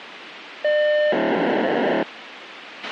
POCSAG pager data (1200 baud), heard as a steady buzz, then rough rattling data, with radio hiss and a squelch burst at the end.